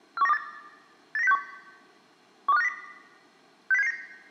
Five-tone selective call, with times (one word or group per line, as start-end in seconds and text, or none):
0.2-0.4 41928
1.2-1.4 89061
2.5-2.7 12590
3.7-3.9 60779